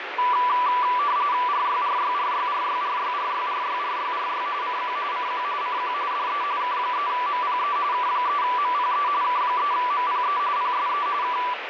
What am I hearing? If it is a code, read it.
RTTY (45.45 baud, 170 Hz shift), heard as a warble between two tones, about 1080 Hz centre, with radio static. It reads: RYRYRYRYRYRYRYRYRY CQ CQ CQ DE K3MPE K3MPE K3MPE PSE K